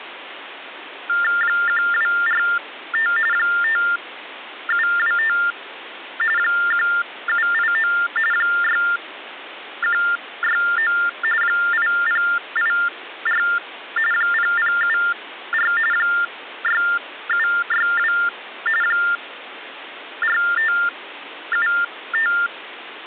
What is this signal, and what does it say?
TTY/TDD text telephone tones (45.45 baud Baudot), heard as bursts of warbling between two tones, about 400 Hz shift, 1600 Hz centre, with phone line noise. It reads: 1245 5725 1789 6169 8084 0074 6762 4575